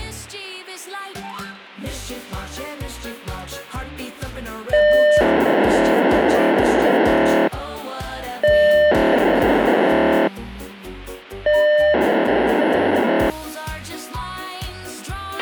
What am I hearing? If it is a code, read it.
POCSAG pager data (1200 baud), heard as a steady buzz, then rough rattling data, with a squelch burst at the end.